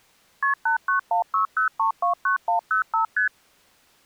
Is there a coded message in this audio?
Yes: multi-frequency trunk signalling (R1, as on North American trunks) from 0.4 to 3.3 s, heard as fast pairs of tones, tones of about 110 ms. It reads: KP 89160329105 ST